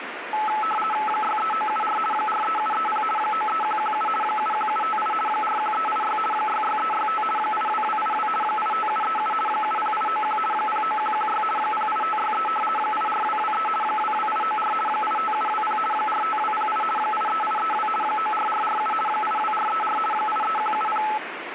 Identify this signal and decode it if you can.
RTTY (50 baud, 450 Hz shift), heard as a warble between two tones, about 1080 Hz centre, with radio static. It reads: 63974 43730 93117 71758 41386 66365 82282 85737 70891 09116 08563 84223 22894 85720 45208 83832 94447 82434 83170